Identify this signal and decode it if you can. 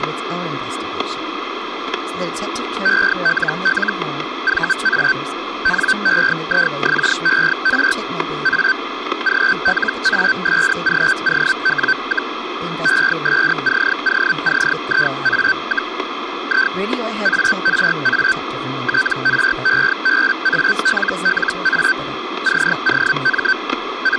Hellschreiber (Feld-Hell, 122.5 baud), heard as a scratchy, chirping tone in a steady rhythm, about 1550 Hz, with static crashes and speech in English. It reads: ELL VA NEIXER A GLASGOW, ESCOCIA, I ARA TREBALLA COM …